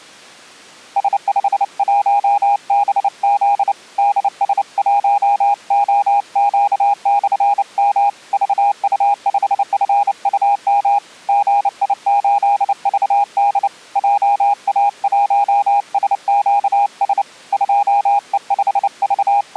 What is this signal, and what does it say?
Morse code, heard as a keyed tone, hand-sent with a paddle, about 29 wpm, 810 Hz. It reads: S51BZ DS1OQ/M VU5FUM GI8VD JA1SQS …